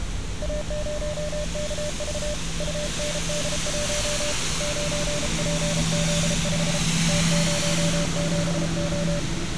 Morse code, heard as a keyed tone, hand-sent with a paddle, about 33 wpm, 590 Hz, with street noise. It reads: A0KV UND1 9PZ5 T07O